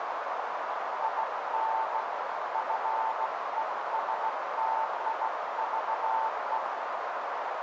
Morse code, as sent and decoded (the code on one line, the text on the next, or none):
.. -. / ..-. . ... - .. ...- .
IN FESTIVE